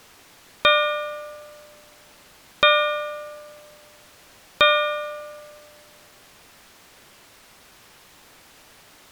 Clock strike, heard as a bell. 3. Three o'clock.